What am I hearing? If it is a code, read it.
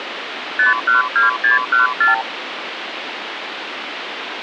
Multi-frequency trunk signalling (R2, with the far end's replies), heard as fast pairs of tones, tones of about 140 ms, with phone line noise. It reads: 512614